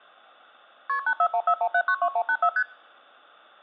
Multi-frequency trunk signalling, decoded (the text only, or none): KP 84141792184 ST